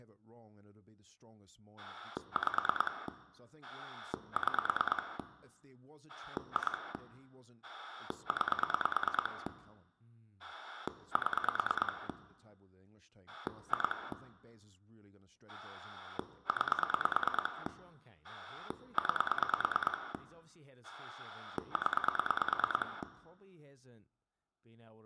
Pulse dialling, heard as a rotary dial, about 9 pulses a second, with room echo and speech in English. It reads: 5 6 2 9 7 2 9 9 0